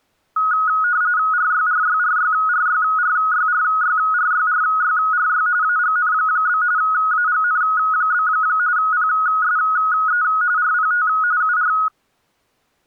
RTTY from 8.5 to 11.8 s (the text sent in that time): PSE RPT UR